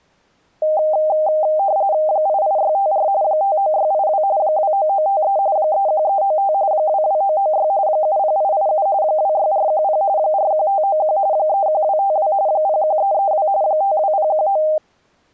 RTTY (45.45 baud, 170 Hz shift), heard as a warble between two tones, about 700 Hz centre. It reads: 88654 59682 29953 31395 22996 70887 26410 41591 31252 01332 52019